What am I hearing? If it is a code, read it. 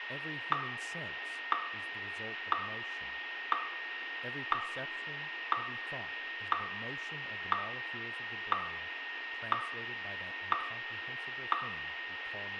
Radio time signal (WWVH, Hawaii), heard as ticks, one a second, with radio static, a steady whistle near 1850 Hz, room echo and speech in English.